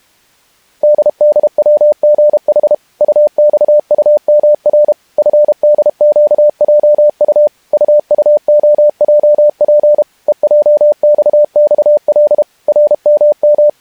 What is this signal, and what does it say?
Morse code, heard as a keyed tone, machine-sent, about 32 wpm, 600 Hz. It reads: DDWGH UXUMR FDQJU UUOJP EJXXL …